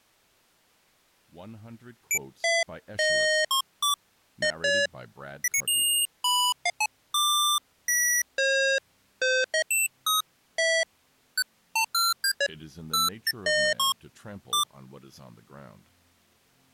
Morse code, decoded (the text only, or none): none